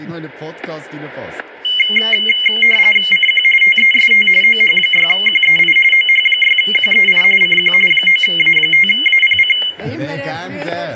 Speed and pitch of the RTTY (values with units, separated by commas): 45.45 baud, 850 Hz shift, 2550 Hz centre